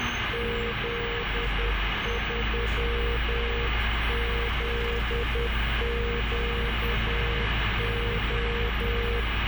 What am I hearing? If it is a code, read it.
Morse code, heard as a keyed tone, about 10 wpm, 470 Hz, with heavy radio static and the noise inside a bus. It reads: Z3ZQO